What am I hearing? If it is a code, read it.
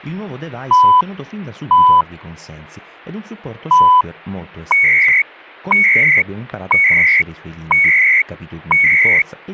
Radio time signal (CHU, Canada), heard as beeps and data bursts, one a second, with static crashes and speech in Italian.